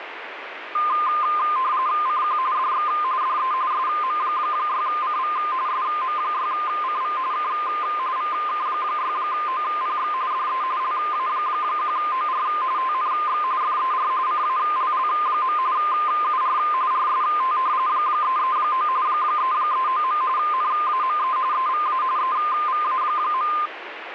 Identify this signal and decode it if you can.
RTTY (45.45 baud, 170 Hz shift), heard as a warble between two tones, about 1130 Hz centre, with radio static. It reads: CQ DX DE SM6CV SM6CV K VK6OPX DE LA1OR TNX FER CALL. UR RST 339 339. NAME EVA EVA.